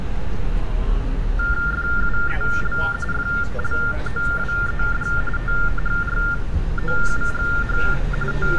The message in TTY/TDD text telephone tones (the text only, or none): FUEL FLOWED THROUGH …